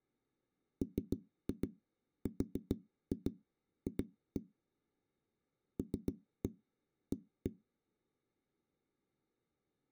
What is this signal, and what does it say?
Tap code, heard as knocks on a wall, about 7 knocks a second. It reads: MRF LA